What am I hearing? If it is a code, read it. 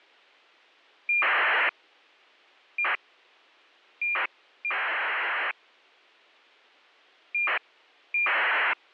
ACARS aircraft data, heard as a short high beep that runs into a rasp, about 2400 baud.